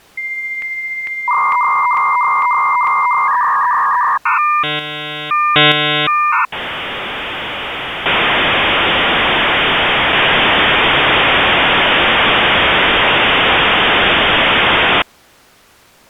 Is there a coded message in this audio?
Yes: dial-up modem handshake (V.34 or later) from 0.2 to 15.0 s, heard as a whistle, warbles, then hiss.